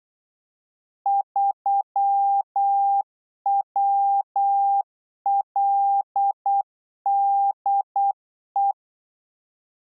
Morse code, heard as a keyed tone, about 8 wpm, 800 Hz. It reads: 3WLDE